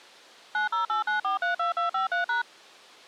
DTMF, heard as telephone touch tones, dialled by machine, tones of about 130 ms. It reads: 9089432253#